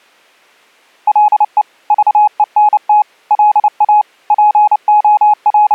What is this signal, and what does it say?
Morse code, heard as a keyed tone, machine-sent, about 29 wpm, 840 Hz. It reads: LE VENT LA …